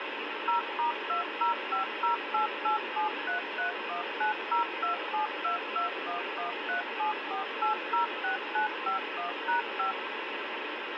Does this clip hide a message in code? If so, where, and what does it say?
Yes: DTMF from 0.5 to 9.9 s, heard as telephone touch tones, dialled by machine, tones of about 120 ms, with radio hiss. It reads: 0*205088733190272211374806951#5